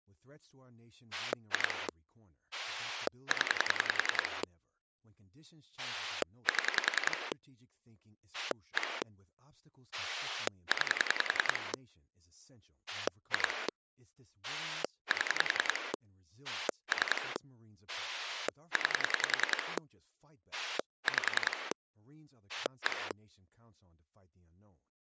Pulse dialling, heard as a rotary dial, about 10 pulses a second, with speech in English. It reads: 2 0 7 1 9 2 7 3 9 5 1